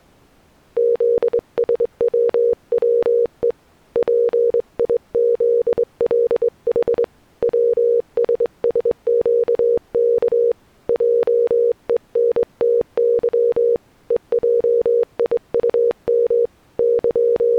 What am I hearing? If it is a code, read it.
Morse code, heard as a keyed tone, hand-sent with a straight key, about 23 wpm, 470 Hz. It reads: ZSWWE PIZLH WSSQK JENTY EJIUM …